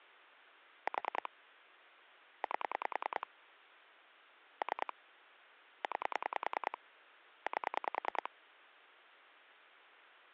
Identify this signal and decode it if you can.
Pulse dialling, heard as clicks on a phone line, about 10 pulses a second. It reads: 4 8 3 9 8